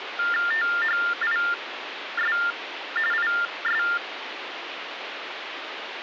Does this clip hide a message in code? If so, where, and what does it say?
Yes: TTY/TDD text telephone tones (45.45 baud Baudot) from 0.2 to 4.0 s, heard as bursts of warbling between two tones, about 400 Hz shift, 1600 Hz centre, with phone line noise. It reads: THIS IS